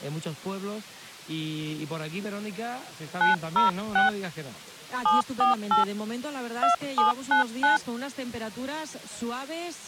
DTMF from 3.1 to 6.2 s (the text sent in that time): 906 748